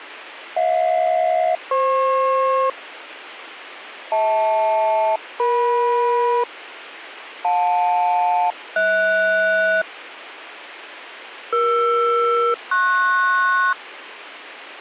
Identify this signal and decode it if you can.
Aircraft SELCAL, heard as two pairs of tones. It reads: HJ-FP HL-EM JL-HS ER-PS